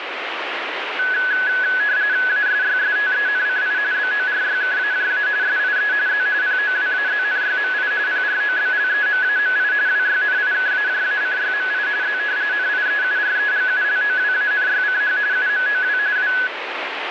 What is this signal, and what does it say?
RTTY (45.45 baud, 170 Hz shift), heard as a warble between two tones, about 1600 Hz centre, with radio static. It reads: ASYSTENCI BORYKAJA SIE Z POWAZNYMI PROBLEMAMI WYNIKAJACYMI Z NIEUREGULOWANYCH UMOW W